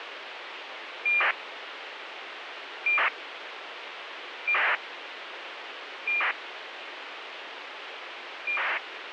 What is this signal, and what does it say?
ACARS aircraft data, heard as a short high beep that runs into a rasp, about 2400 baud, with radio hiss.